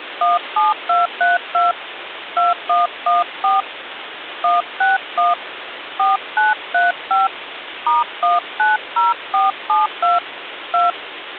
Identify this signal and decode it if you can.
DTMF, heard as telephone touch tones, dialled by hand, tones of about 160 ms, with phone line noise. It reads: 17232 2114 161 4935 *190472 2